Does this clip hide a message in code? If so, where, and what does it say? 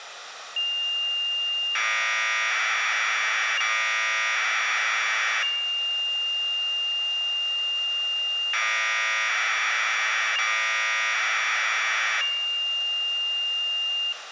Yes: Commodore tape loading (standard loader) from 0.6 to 14.1 s, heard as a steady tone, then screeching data, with room echo.